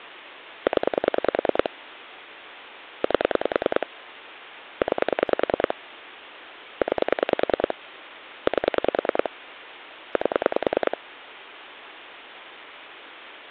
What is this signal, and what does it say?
Pulse dialling, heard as clicks on a phone line, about 10 pulses a second, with phone line noise. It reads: 0 8 9 9 8 8